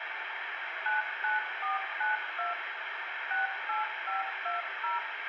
DTMF, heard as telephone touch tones, dialled by machine, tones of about 150 ms, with radio hiss and room echo. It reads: 99492 68520